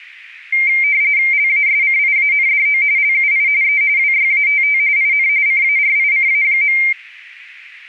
RTTY (45.45 baud, 170 Hz shift), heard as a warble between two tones, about 2200 Hz centre. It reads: LASCIANDO LUI E WYATT IN CARICA.